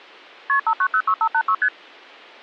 Multi-frequency trunk signalling (R1, as on North American trunks), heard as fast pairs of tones, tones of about 70 ms. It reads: KP 5906586 ST